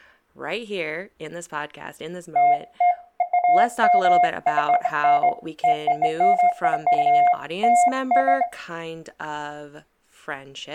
Beeps of irregular length, with speech in English. There is no code.